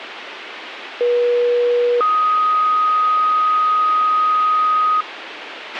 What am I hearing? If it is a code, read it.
Two-tone page, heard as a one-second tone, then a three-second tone, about 480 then 1250 Hz, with radio hiss and a squelch burst at the end.